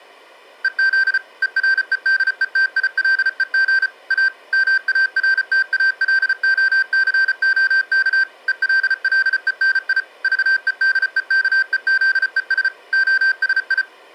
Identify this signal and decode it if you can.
Morse code, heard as electronic beeps, machine-sent, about 34 wpm, 1550 Hz. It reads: EZ EREDETILEG A MARTALOCOK ELLENI VEDEKEZES OSI